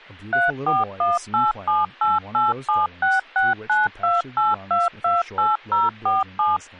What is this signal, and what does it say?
DTMF, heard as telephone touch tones, dialled by machine, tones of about 180 ms, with speech in English. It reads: 3418788766928228047